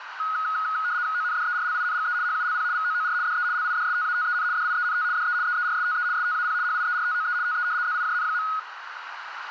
RTTY (75 baud, 170 Hz shift), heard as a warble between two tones, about 1360 Hz centre, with radio static and a narrow filter. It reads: ONDERLINGE HULP VOOR DE LIDSTATEN DIENT DE EERSTE STAP HIERTOE TE ZIJN.